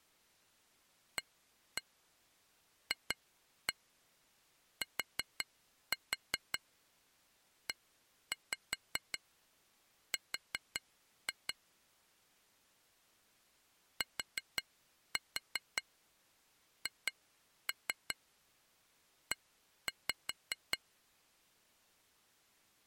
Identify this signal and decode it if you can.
Tap code, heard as taps on glass, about 5 knocks a second. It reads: AFTER THE